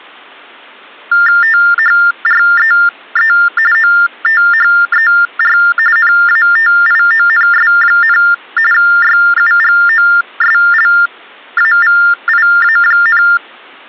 TTY/TDD text telephone tones (45.45 baud Baudot), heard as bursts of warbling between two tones, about 400 Hz shift, 1600 Hz centre. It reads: THREE OTHER NATIONS, YUGOSLAVIA,